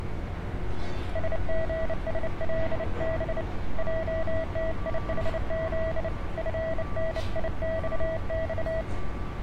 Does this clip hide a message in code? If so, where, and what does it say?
Yes: Morse code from 1.1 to 8.9 s, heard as a keyed tone, hand-sent with a bug key, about 29 wpm, 650 Hz, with street noise. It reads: SGSLB JTIHZ FNIXX